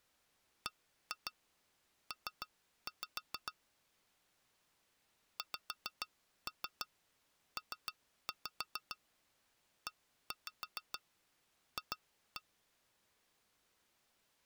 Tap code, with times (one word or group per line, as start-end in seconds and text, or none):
0.7-3.5 BP
5.4-12.4 XPEF